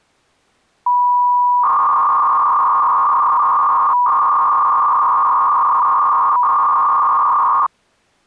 300-baud modem data (V.21 tones), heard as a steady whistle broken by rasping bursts, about 300 baud, 200 Hz shift.